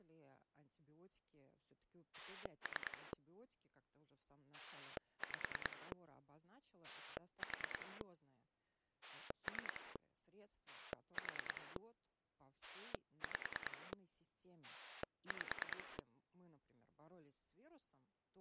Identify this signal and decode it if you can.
Pulse dialling, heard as a rotary dial, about 10 pulses a second, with speech in Russian. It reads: 3 5 4 3 4 5 5